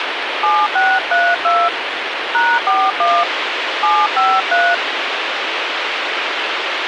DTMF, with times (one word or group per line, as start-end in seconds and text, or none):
0.4-1.7 7632
2.3-3.2 #41
3.8-4.7 753